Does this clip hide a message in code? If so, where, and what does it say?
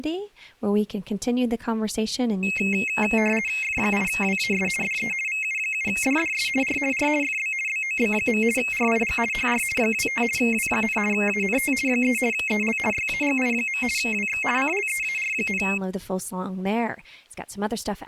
Yes: RTTY (50 baud, 450 Hz shift) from 2.4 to 15.8 s, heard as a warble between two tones, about 2350 Hz centre, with speech in English. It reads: F8WAS DE VU7DDS R R FB BOB. RIG HR 25 W, ANT 3 EL YAGI. WX CLEAR,